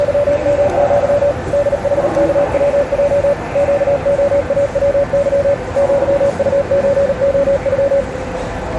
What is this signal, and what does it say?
Morse code (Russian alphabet), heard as a keyed tone, machine-sent, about 38 wpm, 570 Hz, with the noise of a subway station. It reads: … ДХКВЙ ЩОАВЫ ЪУЧОЮ